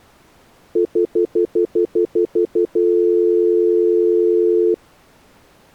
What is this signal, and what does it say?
Telephone call progress tone (North American plan), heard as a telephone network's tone, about 350, 440 Hz, 0.1 s on and 0.1 s off. Stutter dial tone.